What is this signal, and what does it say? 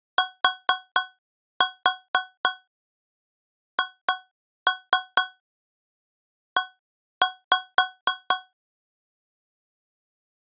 Tap code, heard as taps on a metal pipe, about 4 knocks a second. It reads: THE